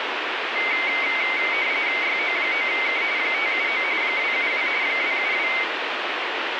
RTTY (45.45 baud, 170 Hz shift), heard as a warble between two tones, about 2150 Hz centre, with radio static. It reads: YO9K 579 272 272